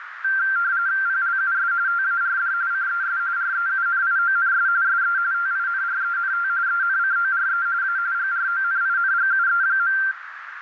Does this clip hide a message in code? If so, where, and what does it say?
Yes: RTTY (45.45 baud, 170 Hz shift) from 0.2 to 10.1 s, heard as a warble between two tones, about 1470 Hz centre, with radio static and a narrow filter. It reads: PLUS TARD CES REUNIONS SE TINRENT ENCORE A GRONINGUE.